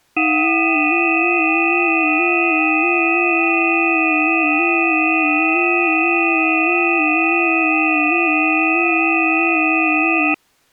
FT8 (several signals at once), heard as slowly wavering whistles, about 6.25 baud.